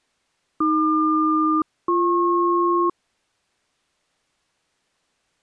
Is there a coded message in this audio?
Yes: aircraft SELCAL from 0.6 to 2.9 s, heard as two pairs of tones. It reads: AQ-BP